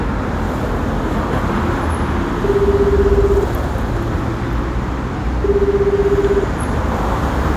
Telephone call progress tone (Japanese plan), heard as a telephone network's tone, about 380, 400, 420 Hz, 1 s on and 2 s off, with street noise. Ringback tone.